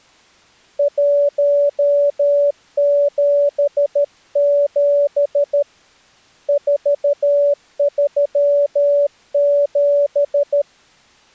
Morse code, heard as a keyed tone, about 13 wpm, 570 Hz. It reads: 177 437